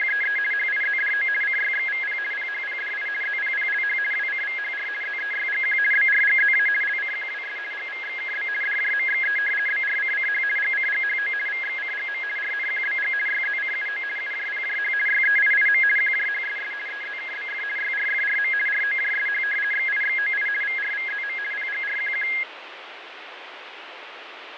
RTTY (50 baud, 450 Hz shift), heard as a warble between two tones, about 1900 Hz centre, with radio static and fading. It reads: … HIZDO CYXVP PHPDI ZPPLH WCVHR ZEYGQ BRGZA LCQWS GVXKB DJMXE BRCCH GCGHO VXCGM RNQBG YZCUO UJPJH YEIIM QJHSS EZKBF YRFRM ROJSH XIXOI VRVZM PGRQQ